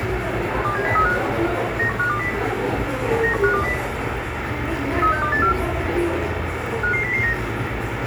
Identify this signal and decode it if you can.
Five-tone selective call (CCIR), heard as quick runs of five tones, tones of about 100 ms, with radio hiss, a squelch burst at the end, room echo and the noise of a crowd indoors. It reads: 27035 91520 91520 36284 55009